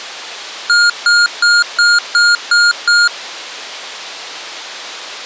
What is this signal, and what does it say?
Beep code, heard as beeps from a small speaker, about 1420 Hz. 7 short. In AMI BIOS tables: virtual mode exception error; in Dell tables: processor failure.